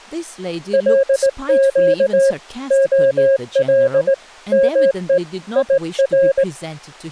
Morse code, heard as a keyed tone, hand-sent with a straight key, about 18 wpm, 540 Hz, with speech in English. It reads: LQ OL ME IR